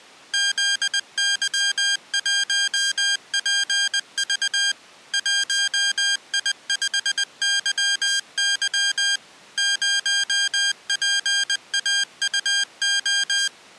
Morse code, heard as electronic beeps, machine-sent, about 20 wpm, 1600 Hz. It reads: ZY1PV 1I5YY 0PAUO